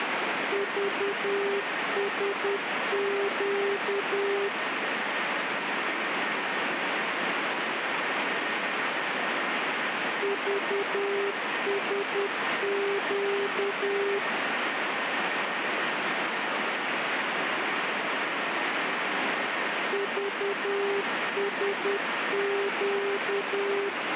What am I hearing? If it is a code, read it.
Morse code, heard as a keyed tone, machine-sent, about 10 wpm, 400 Hz, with radio static. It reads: VSQ VSQ VSQ